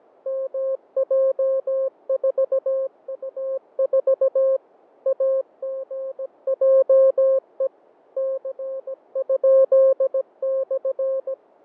Morse code, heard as a keyed tone, machine-sent, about 17 wpm, 530 Hz, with fading. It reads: MJ4U4 AGJE C?/